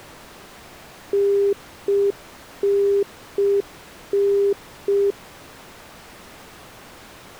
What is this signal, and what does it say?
Telephone call progress tone (UK plan), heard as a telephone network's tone, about 400 Hz. Congestion tone.